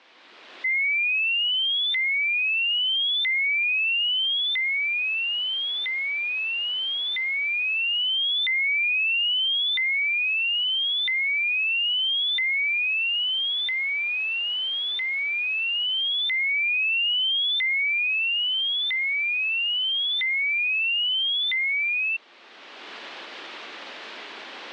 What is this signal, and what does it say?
A tone that sweeps in pitch again and again. There is no code.